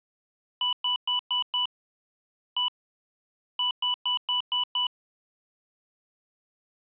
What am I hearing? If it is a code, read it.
Beep code, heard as beeps from a small speaker, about 990 Hz. 5-1-6.